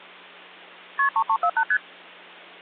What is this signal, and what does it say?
Multi-frequency trunk signalling (R1, as on North American trunks), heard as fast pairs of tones, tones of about 70 ms, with hum. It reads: KP 3348 ST